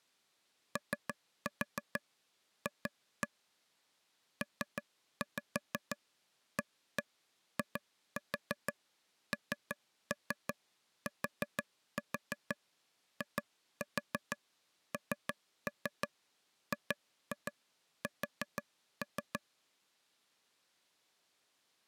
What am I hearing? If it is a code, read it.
Tap code, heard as taps on a table, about 6 knocks a second. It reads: OF PAINTINGS